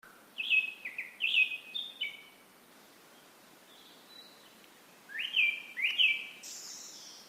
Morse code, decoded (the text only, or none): none